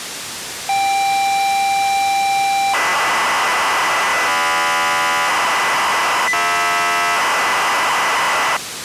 ZX Spectrum tape loading, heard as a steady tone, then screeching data, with tape hiss.